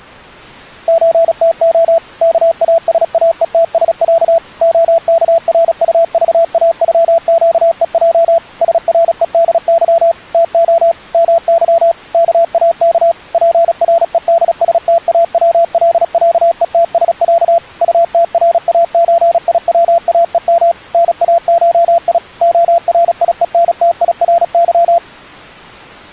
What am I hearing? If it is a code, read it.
Morse code (Russian alphabet), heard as a keyed tone, machine-sent, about 36 wpm, 670 Hz. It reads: ЧТО КАСАЕТСЯ ОКРУЖАЮЩЕЙ СРЕДЫ ТО МЫ КАК ПРЕДСТАВЛЯЕТСЯ УТРАЧИВАЕМ НАШИ ОРИЕНТИРЫ